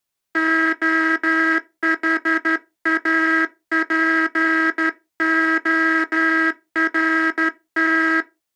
Morse code (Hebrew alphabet), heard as a buzzer, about 12 wpm. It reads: החאפהרת